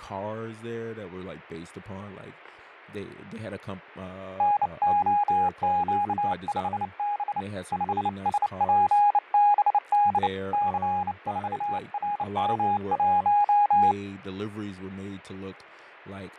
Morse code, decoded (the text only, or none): NOQ5B 5SPBD C4RM1